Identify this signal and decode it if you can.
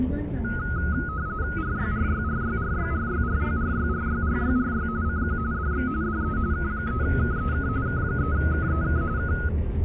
RTTY (45.45 baud, 170 Hz shift), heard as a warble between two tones, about 1360 Hz centre, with the noise inside a bus. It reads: RYRYRYRYRYRYRYRYRYRY CQ DX DE K3KEK K3KEK K